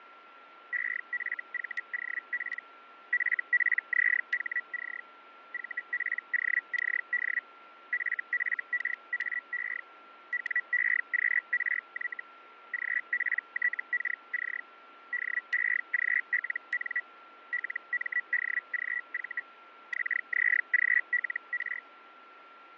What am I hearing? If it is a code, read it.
Hellschreiber (Feld-Hell, 122.5 baud), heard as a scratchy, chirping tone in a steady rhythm, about 1950 Hz, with radio static, fading and a steady whistle near 1360 Hz. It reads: EFVOP FPZHC VPOCD FFKAE WEQRY GPTKC DEGLN LMDGV XZGLR